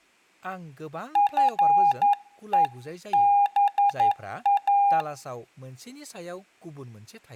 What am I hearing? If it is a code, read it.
Morse code (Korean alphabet), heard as a keyed tone, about 11 wpm, 810 Hz, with room echo and speech in Bodo. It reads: 나도